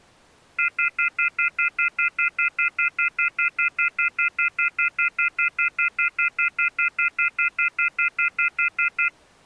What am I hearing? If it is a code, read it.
Telephone call progress tone (North American plan), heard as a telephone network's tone, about 1400, 2050, 2450, 2600 Hz, 0.1 s on and 0.1 s off. Off-hook warning tone.